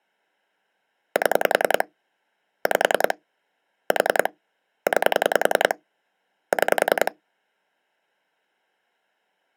Pulse dialling, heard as clicks on a phone line, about 10 pulses a second. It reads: 7 5 4 9 6